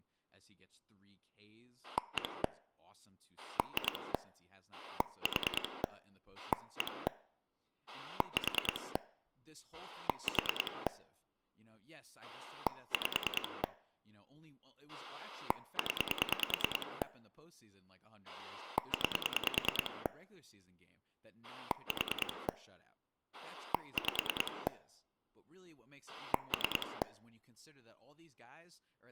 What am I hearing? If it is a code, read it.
Pulse dialling, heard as a rotary dial, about 9 pulses a second, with speech in English. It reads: 1 2 4 1 4 4 5 0 9 4 5 3